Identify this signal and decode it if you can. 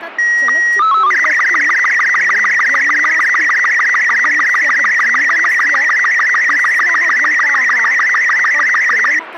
SSTV (slow-scan television), Robot 36, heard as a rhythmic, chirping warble, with radio static and speech in Sanskrit.